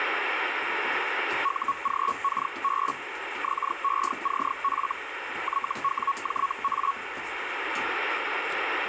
Hellschreiber (Feld-Hell, 122.5 baud), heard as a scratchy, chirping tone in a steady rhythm, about 1110 Hz, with radio static and kitchen noise. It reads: UGKB XECF YWJA